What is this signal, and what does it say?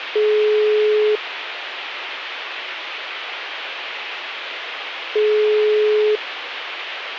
Telephone call progress tone (single-tone plan, as in most of Europe), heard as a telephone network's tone, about 420 Hz, 1 s on and 4 s off. Ringback tone.